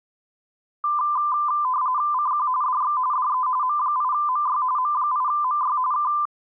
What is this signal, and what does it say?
RTTY (45.45 baud, 170 Hz shift), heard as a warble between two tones, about 1100 Hz centre. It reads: CQ DX DE M8MY M8MY K